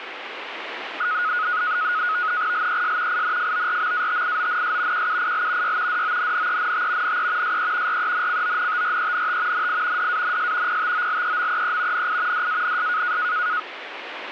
NAVTEX (SITOR-B), 100 baud, 170 Hz shift, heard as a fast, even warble, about 1360 Hz centre, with radio static. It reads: LES INFORMATIONS QUIL Y DONNENT NE SE RENCONTRENT NI DANS PTOLEMEE NI DANS